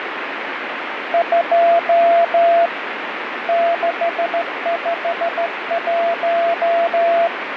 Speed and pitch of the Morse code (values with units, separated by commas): 14 wpm, 680 Hz